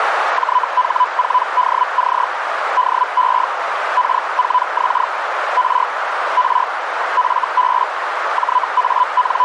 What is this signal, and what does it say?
Hellschreiber (Feld-Hell, 122.5 baud), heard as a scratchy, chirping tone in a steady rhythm, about 1000 Hz, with radio static and a narrow filter. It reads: JH4DC DE K4X R R FB …